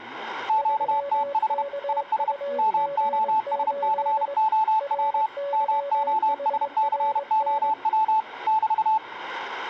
Morse code, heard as two keyed tones, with the noise of a crowd indoors. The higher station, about 31 wpm, 870 Hz: QTH IS MOSCOW MOSCOW <BT>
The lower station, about 22 wpm, 560 Hz: 3KUG8 RYHRN